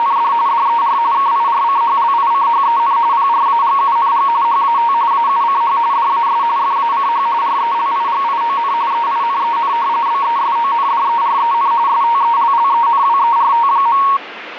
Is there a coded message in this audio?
Yes: RTTY (45.45 baud, 170 Hz shift) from 0.0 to 14.2 s, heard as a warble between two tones, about 1020 Hz centre, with radio static. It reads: … DER KIRCHLICHEN PRAGUNG HAT AUCH DAS FACH RELIGION EINEN BESONDEREN STELLENWERT.